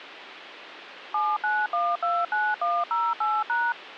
DTMF, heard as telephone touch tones, dialled by machine, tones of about 220 ms, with phone line noise. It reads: 79129108#